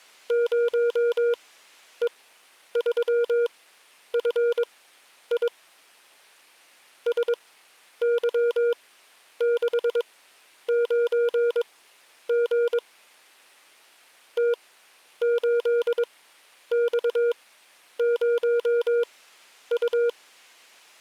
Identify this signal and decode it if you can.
Morse code, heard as a keyed tone, machine-sent, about 22 wpm, spaced as for 10 wpm, 470 Hz. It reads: 0E3FI SY69G T8X0U